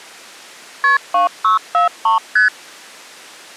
Multi-frequency trunk signalling (R1, as on North American trunks), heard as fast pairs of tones, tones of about 130 ms. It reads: KP 2643 ST